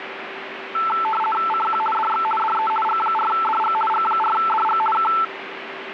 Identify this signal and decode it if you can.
RTTY (50 baud, 450 Hz shift), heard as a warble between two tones, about 1100 Hz centre, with radio static and a steady whistle near 390 Hz. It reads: CQ DX DE G4DG G4DG K